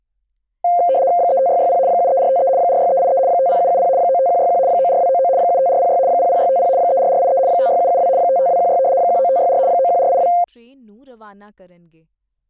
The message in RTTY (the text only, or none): 35660 73453 46383 50770 95161 94299 75406 00650 34483 56772 55216 19564 91482